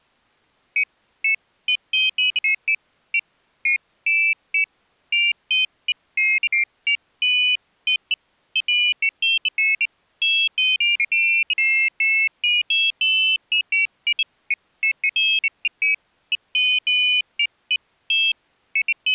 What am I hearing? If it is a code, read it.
Pairs of high tones at irregular times. There is no code.